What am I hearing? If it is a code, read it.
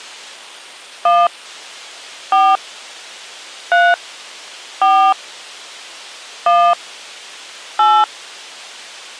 DTMF, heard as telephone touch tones, dialled by hand, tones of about 250 ms. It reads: 1 4 3 4 1 8